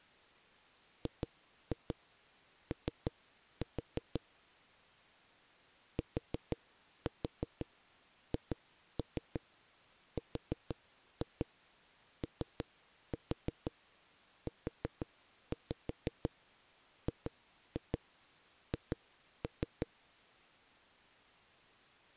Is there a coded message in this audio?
Yes: tap code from 1.1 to 19.9 s, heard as knocks on a wall, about 6 knocks a second. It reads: GO THROUGH